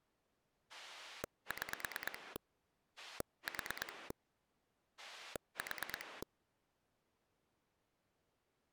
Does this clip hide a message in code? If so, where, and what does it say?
Yes: pulse dialling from 0.7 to 6.2 s, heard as a rotary dial, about 9 pulses a second. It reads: 6 4 4